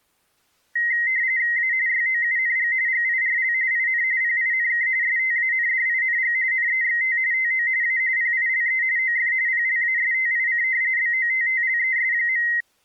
RTTY (45.45 baud, 170 Hz shift), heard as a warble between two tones, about 2000 Hz centre. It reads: A YOUNG GIRL IN PINK STANDING NEXT TO A PILE OF PLASTIC BOTTLES.